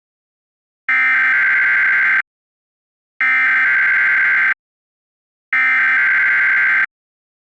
Emergency Alert System (SAME) tones (header bursts), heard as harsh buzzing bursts, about 520.83 baud.